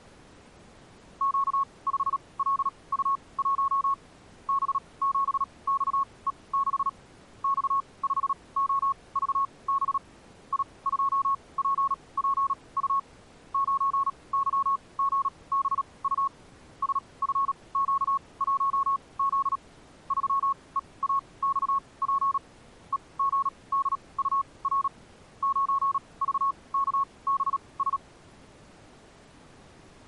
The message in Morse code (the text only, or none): Q5LU1 B7XE6 X5OVB I2PPU 9YGBU SFQ1Z 3EAXP EGDUR 9VKBS